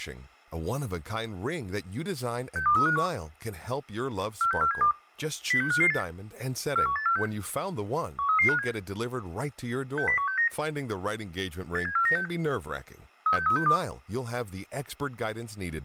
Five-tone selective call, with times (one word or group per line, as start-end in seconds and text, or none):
2.6-3.1 62351
4.4-4.9 46472
5.5-6.0 06558
6.8-7.3 41846
8.2-8.7 13357
10.0-10.5 60169
11.8-12.3 87496
13.3-13.8 36362